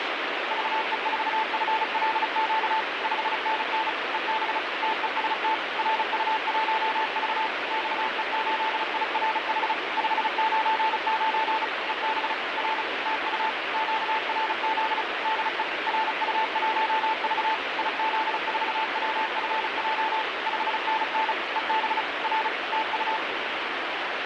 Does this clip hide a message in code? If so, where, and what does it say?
Yes: Morse code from 0.4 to 23.2 s, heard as a keyed tone, machine-sent, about 35 wpm, 880 Hz, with heavy radio static. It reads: VE4FLQ 5NN EB TEST RU1V XE8IRH 599 EB R TU QRZ DE RU1V IZ4WFJ 5NN EB R TU